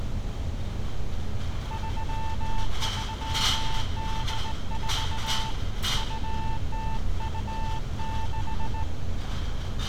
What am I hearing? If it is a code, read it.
Morse code (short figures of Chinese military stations), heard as a keyed tone, hand-sent with a straight key, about 18 wpm, 890 Hz, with street noise. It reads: 3384 2026